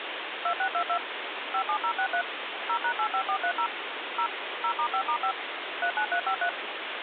DTMF, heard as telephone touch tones, dialled by machine, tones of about 80 ms, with phone line noise. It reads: 2622 57063 0#85430 0 0*5*5 39353